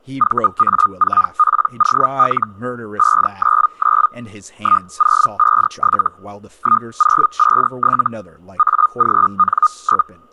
Hellschreiber (Feld-Hell, 122.5 baud), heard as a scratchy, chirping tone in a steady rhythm, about 1230 Hz, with speech in English. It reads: VA4POL 599 1057 1057 AGN?